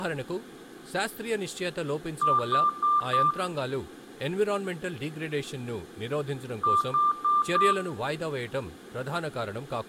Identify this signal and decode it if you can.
Beep code, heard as beeps, played twice, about 1190 Hz, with room echo and speech in Telugu. 4 short. In AMI BIOS tables: system timer failure; in Dell tables: memory read or write failure.